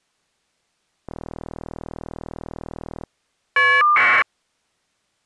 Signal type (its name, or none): caller ID data burst